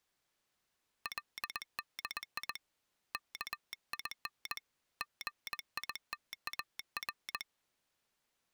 Morse code (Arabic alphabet), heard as a telegraph sounder, hand-sent with a paddle, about 20 wpm. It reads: لدي كين غيتار